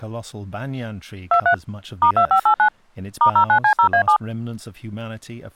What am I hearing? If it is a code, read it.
DTMF, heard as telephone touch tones, dialled by machine, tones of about 90 ms, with speech in English. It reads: 23 *2589 *09C0A7